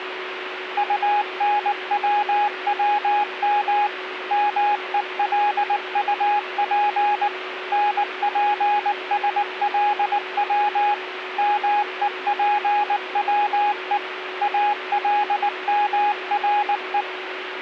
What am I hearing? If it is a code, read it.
Morse code, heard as a keyed tone, machine-sent, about 19 wpm, 830 Hz, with radio static and a steady whistle near 370 Hz. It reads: UNWWM MELUP NPSLW MEPWE ALMRE